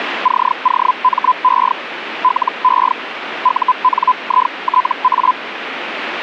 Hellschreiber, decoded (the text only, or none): COME LE UNITA